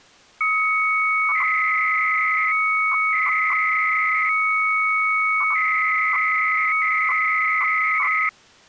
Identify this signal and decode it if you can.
300-baud modem data (Bell 103 tones), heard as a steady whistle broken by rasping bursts, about 300 baud, 200 Hz shift.